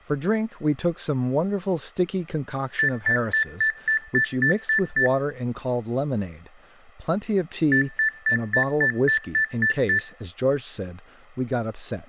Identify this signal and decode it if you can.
Beep code, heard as beeps from a small speaker, played twice, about 1750 Hz, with room echo and speech in English. 9 short. In AMI BIOS tables: ROM checksum failure.